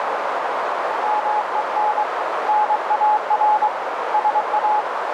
Morse code, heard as a keyed tone, hand-sent with a paddle, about 23 wpm, 850 Hz, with heavy radio static and a narrow filter. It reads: MEN NAR SA